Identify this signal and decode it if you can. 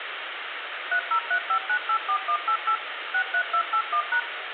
DTMF, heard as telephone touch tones, dialled by machine, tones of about 80 ms, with phone line noise and room echo. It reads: 3035984188 63281#